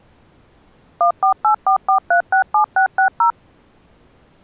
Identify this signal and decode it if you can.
DTMF, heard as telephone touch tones, dialled by machine, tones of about 100 ms. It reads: 14844367660